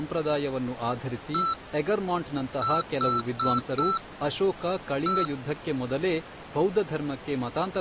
Beep code, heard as beeps from a small speaker, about 1330 Hz, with speech in Kannada. 1-4-1. In Phoenix BIOS tables: address line failure in the first 64 KB of memory.